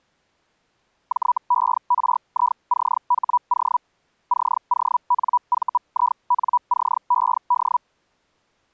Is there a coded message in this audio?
Yes: Hellschreiber (Feld-Hell, 122.5 baud) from 1.1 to 7.8 s, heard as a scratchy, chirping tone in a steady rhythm, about 980 Hz. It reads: JERICHO CONVINCED